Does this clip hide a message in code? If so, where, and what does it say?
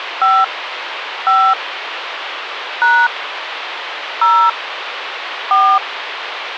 Yes: DTMF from 0.2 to 5.8 s, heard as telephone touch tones, dialled by hand, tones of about 240 ms, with phone line noise. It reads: 5 5 # 0 4